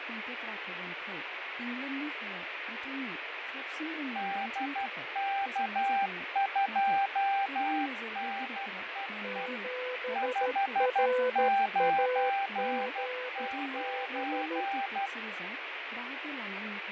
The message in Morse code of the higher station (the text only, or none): DK2NEE 599